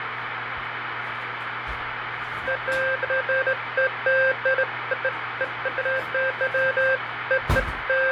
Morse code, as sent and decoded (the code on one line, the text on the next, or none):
none